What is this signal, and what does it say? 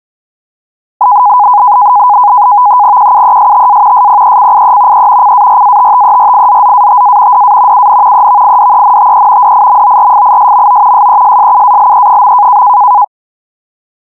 NAVTEX (SITOR-B), 100 baud, 170 Hz shift, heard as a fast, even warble, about 910 Hz centre. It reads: QUESTA SPECIE E CARATTERIZZATA DA UN EVIDENTE DIMORFISMO SESSUALE.